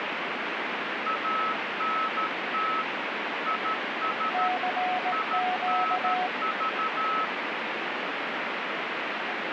Morse code, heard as two keyed tones, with heavy radio static. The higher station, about 13 wpm, 1300 Hz: ANT IS INV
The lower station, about 18 wpm, 730 Hz: CQ